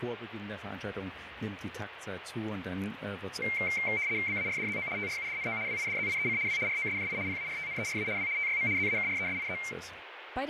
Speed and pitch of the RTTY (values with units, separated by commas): 75 baud, 170 Hz shift, 2200 Hz centre